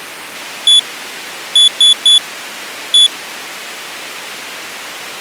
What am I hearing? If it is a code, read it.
Beep code, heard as a piezo beeper, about 3450 Hz. 1-3-1. In Phoenix BIOS tables: memory refresh failure.